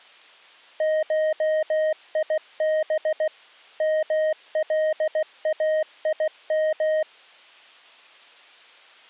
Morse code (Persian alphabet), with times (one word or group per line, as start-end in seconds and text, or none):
0.8-3.3 شیب
3.8-7.0 ملایم